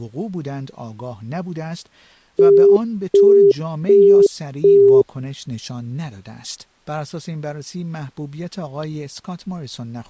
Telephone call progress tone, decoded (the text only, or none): busy tone